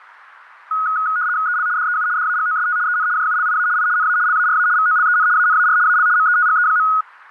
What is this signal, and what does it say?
RTTY (75 baud, 170 Hz shift), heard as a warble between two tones, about 1360 Hz centre, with radio static. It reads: EL DEU DAGOST EN JULIA I NA LARA VOLEN ANAR AL METGE.